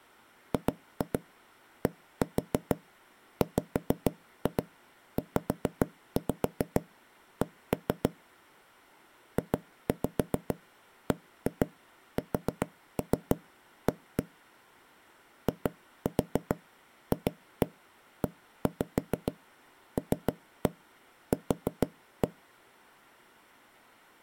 Tap code, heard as knocks on wood, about 6 knocks a second. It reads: GDWZC JBSA IFELQ